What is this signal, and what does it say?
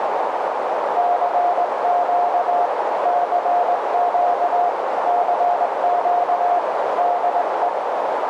Morse code, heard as a keyed tone, hand-sent with a straight key, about 19 wpm, 710 Hz, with heavy radio static and a narrow filter. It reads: CQ CQ CQ DE